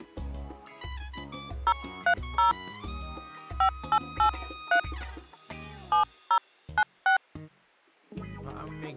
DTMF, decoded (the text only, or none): 030 5883 7096